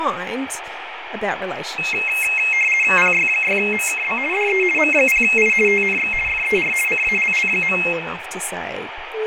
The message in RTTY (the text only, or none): PY6MKB DE M0I TNX FER CALL.